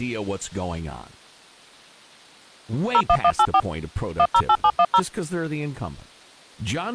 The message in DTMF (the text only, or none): 01184 108710